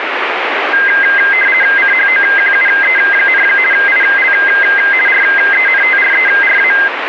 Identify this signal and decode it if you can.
RTTY (50 baud, 450 Hz shift), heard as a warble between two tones, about 1850 Hz centre, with radio static. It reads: CHOQUE, IL RENTRERA